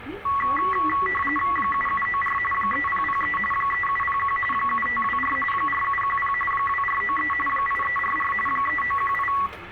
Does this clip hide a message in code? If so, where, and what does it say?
Yes: RTTY (45.45 baud, 850 Hz shift) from 0.3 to 9.5 s, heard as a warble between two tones, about 1550 Hz centre, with radio static and the noise inside a bus. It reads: 7794 3003 3701 7524 4710 2493 8344 3918